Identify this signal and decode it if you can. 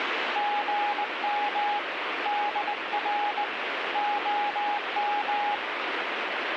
Morse code, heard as a keyed tone, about 19 wpm, 830 Hz, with radio static. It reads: GM DR OM